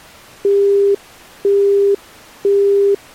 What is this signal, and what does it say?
Telephone call progress tone (single-tone plan, as in Europe, Japan and elsewhere), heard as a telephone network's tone, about 400 Hz, 0.5 s on and 0.5 s off. Busy tone.